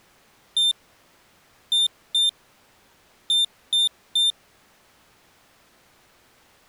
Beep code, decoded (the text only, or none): 1-2-3